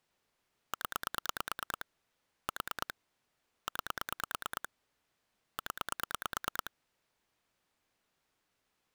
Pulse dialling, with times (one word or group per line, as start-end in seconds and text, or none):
0.7-1.8 0
2.5-2.9 4
3.7-4.7 9
5.6-6.7 0